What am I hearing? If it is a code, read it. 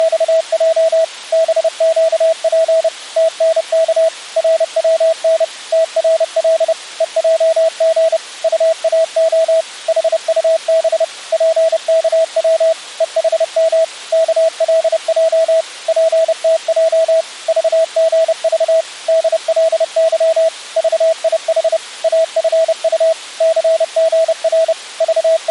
Morse code, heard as a keyed tone, machine-sent, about 30 wpm, 650 Hz. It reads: … BQP TNK RWN TRL EJG UAO HUB PKW EHM KLJ PTJ VGV DLY VIH AFU CGR …